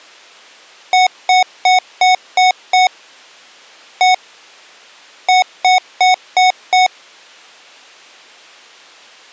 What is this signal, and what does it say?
Beep code, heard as beeps from a small speaker, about 740 Hz. 6-1-5.